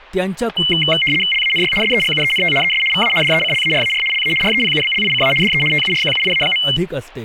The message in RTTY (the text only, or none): LANY SEGUENT ES VA DECLARAR LA REPUBLICA DE TURQUIA.